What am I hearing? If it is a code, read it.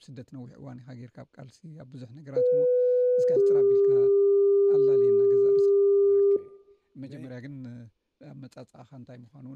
Two-tone page, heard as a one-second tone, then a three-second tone, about 500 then 400 Hz, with room echo.